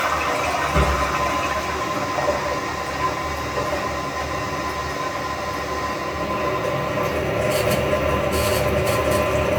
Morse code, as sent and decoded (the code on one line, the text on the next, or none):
none